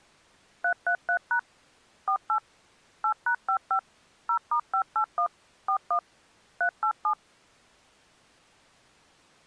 DTMF, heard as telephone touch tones, dialled by machine, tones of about 80 ms. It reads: 333# 48 8#55 0*581 41 387